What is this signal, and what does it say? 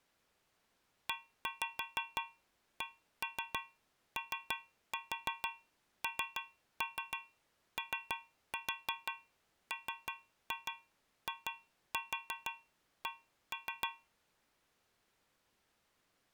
Tap code, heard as taps on a metal pipe, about 6 knocks a second. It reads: ECONOMIC